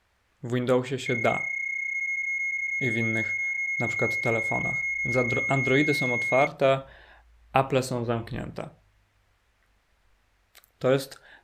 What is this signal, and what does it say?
PSK31 (31.25 baud), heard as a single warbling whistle, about 2150 Hz, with speech in Polish.